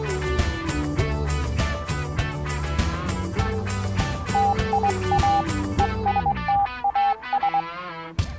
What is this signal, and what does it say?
Morse code, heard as a keyed tone, hand-sent with a straight key, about 21 wpm, 800 Hz. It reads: TIA ESTAS